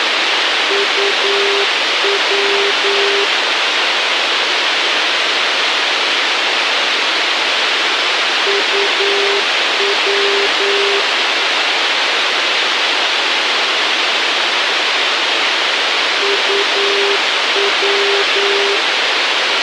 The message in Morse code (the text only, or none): UW UW UW